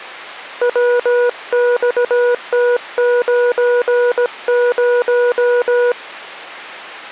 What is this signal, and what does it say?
Morse code, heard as a keyed tone, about 17 wpm, 490 Hz. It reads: WXT90